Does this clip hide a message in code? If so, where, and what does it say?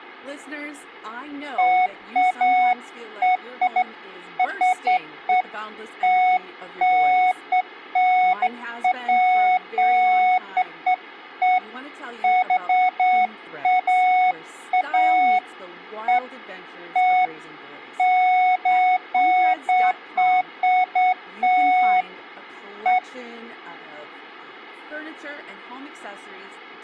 No, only beeps of irregular length, with speech in English.